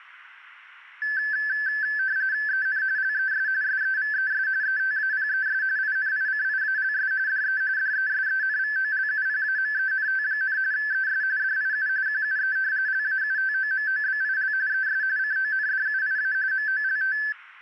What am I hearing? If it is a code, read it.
RTTY (45.45 baud, 170 Hz shift), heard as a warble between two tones, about 1650 Hz centre. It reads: EN LES SEVES ETAPES INICIALS DE DESENVOLUPAMENT, ES DIU QUE LAUTOMOBIL ES CONDUIA MOLT